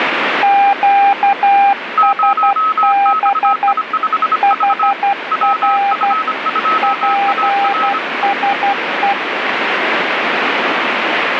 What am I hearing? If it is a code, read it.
Morse code, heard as two keyed tones, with radio static. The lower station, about 12 wpm, 800 Hz: QSB HR PSE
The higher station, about 25 wpm, 1290 Hz: 0XI5V WF2AR